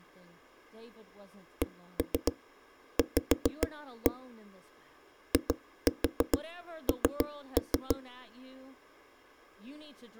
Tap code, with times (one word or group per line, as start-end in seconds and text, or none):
1.6-4.1 CV
5.3-8.0 IN